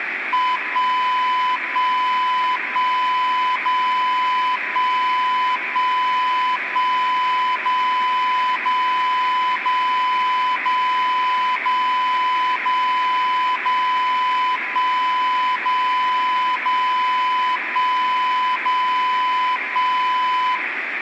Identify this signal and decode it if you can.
Radio time signal (DCF77), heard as a tone whose level steps once a second, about 1000 Hz, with radio static and room echo. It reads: 1 1 1 0 1 1 1 0 0 0 0 0 0 0 1 0 0 1 0 1